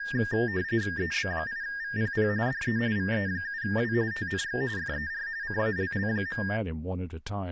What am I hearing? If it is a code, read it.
RTTY (45.45 baud, 170 Hz shift), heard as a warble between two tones, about 1700 Hz centre, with speech in English. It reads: EB8VPP DE VE7W TNX FER CALL.